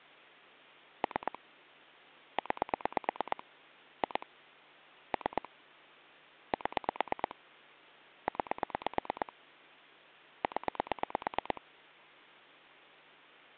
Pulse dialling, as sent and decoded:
3 / 9 / 2 / 3 / 7 / 9 / 10
3 9 2 3 7 9 0

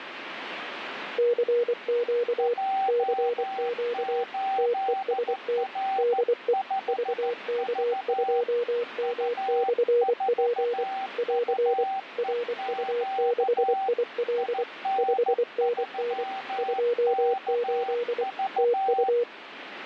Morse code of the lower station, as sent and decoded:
-.-. --.- / -.-. --.- / - . ... - / -.. . / ...- -.- ..--- -- -..-. .--. / .-.-. / .-. ..- -.... .. .-.. / ..... -. -. / ..--- ---.. / - ..-
CQ CQ TEST DE VK2M/P <AR> RU6IL 5NN 28 TU

